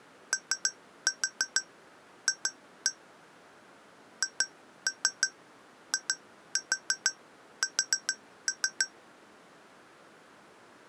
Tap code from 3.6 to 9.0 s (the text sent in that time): HIS